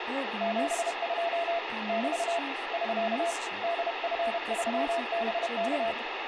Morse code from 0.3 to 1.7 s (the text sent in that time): 72